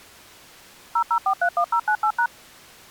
DTMF, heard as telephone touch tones, dialled by machine, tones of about 80 ms. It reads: 00431098#